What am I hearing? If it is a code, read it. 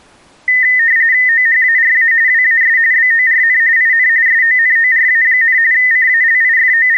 RTTY (45.45 baud, 170 Hz shift), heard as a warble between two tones, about 1900 Hz centre. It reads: OHARA WAS BORN IN SONORA, …